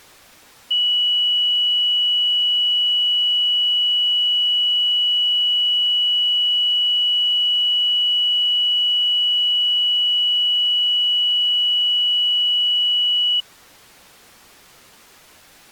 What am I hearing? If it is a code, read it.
A steady tone. There is no code.